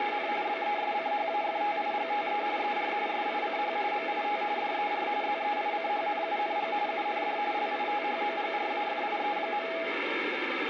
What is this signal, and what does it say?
RTTY (45.45 baud, 170 Hz shift), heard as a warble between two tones, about 740 Hz centre, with radio static. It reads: … BESCHAFTIGTE ER SICH MIT DER ZEICHNUNG UND LITHOGRAFIE.